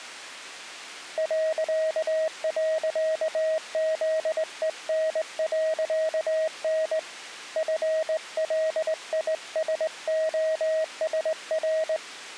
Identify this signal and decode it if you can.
Morse code, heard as a keyed tone, hand-sent with a straight key, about 20 wpm, 630 Hz. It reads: ..ZEN.N FLISOSR